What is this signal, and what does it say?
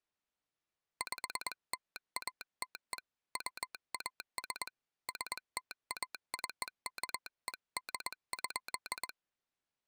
Morse code (American railroad code), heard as a telegraph sounder, hand-sent with a straight key. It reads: PLATE WAS STACKED.